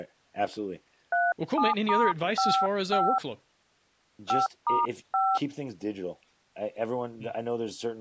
DTMF, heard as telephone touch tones, dialled by hand, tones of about 260 ms, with speech in English. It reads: 37*55 5*5